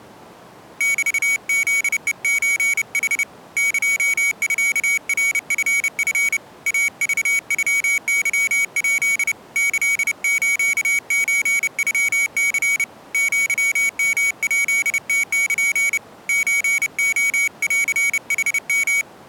Morse code (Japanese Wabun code), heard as a high beeper, hand-sent with a paddle, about 30 wpm, 2250 Hz. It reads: メフヘソヌ エミナチチ イクノケヱ キスソノニ アヨヱムル ソレンヌヨ